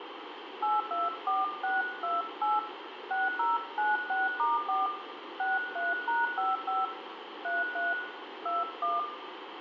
DTMF, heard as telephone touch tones, dialled by hand, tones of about 180 ms, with phone line noise and room echo. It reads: 824628 6096*4 63#55 33 21